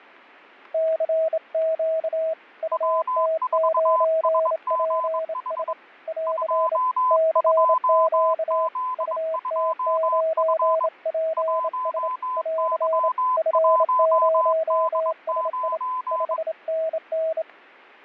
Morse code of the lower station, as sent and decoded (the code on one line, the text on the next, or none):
-.-. --.- / ..- - ----. .--. ... / .-.-. / -.-. --.- / ..- - ----. .--. ... / .-.-. / ..-. ----- ... .. / ..... -. -.
CQ UT9PS <AR> CQ UT9PS <AR> F0SI 5NN